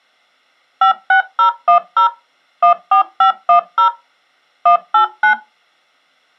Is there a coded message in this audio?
Yes: DTMF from 0.8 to 5.3 s, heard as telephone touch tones, dialled by machine, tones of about 100 ms. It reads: 56010 14510 189